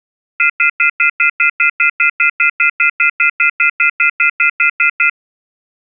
Telephone call progress tone (North American plan), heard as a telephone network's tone, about 1400, 2050, 2450, 2600 Hz, 0.1 s on and 0.1 s off. Off-hook warning tone.